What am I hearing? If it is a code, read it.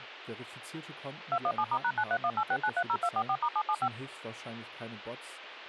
DTMF, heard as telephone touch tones, dialled by machine, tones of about 60 ms, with phone line noise and speech in German. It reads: 217*#93186930244*775